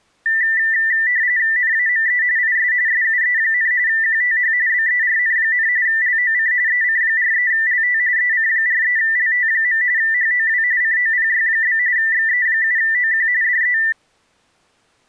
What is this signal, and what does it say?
RTTY (45.45 baud, 170 Hz shift), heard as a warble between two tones, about 1900 Hz centre. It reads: NAME IS SUE, QTH BERN, LOC EC43LT EC43LT. HOW COPY? XE7OQ DE